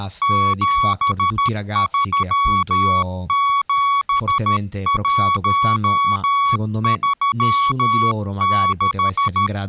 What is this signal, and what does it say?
Morse code, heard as a keyed tone, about 13 wpm, 1120 Hz, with speech in Italian. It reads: 737136